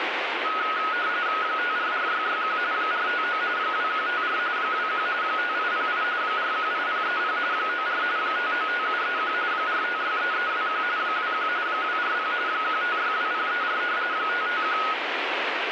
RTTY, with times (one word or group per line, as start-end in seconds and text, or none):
1.4-2.6 544661
2.7-3.4 459
3.6-4.4 2154
4.6-5.1 21
5.2-6.0 5808
6.2-7.4 418030
7.5-8.0 94
8.2-9.3 595731
9.5-10.8 4563321
11.0-11.5 21
11.7-12.3 240
12.5-13.8 1562034
14.1-14.8 551